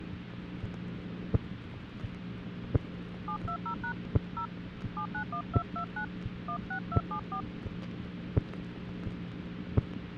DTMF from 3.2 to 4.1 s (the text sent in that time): 720#